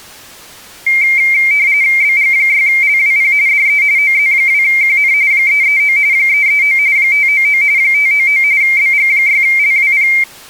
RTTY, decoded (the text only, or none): BG6LWP DE OZ2QN 339 339 599 599 BG6LWP